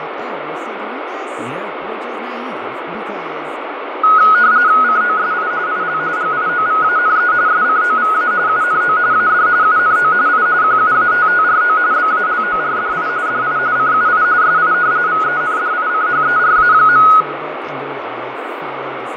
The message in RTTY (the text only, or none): COSI IL GIOVANE SCOVA UNO AD UNO I QUATTRO BALORDI DI CUI SI VENDICHERA.